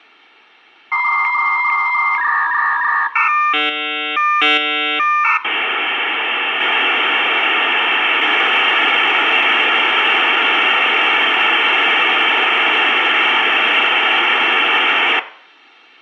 Dial-up modem handshake (V.34 or later), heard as a whistle, warbles, then hiss, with room echo.